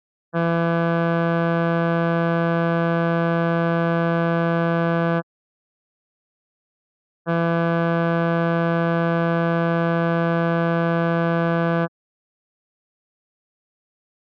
Ship horn signal, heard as a ship's horn, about 170 Hz. 2 long. At sea: a vessel under power that has stopped in fog.